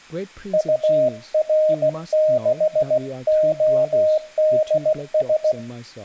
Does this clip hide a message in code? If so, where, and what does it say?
Yes: Morse code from 0.5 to 5.6 s, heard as a keyed tone, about 16 wpm, 620 Hz, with speech in English. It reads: UR6ODS